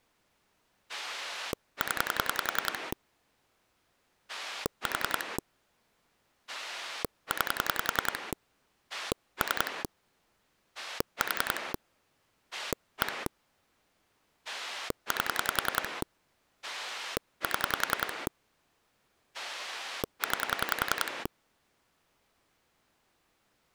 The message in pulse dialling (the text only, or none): 0 4 9 3 4 1 8 7 9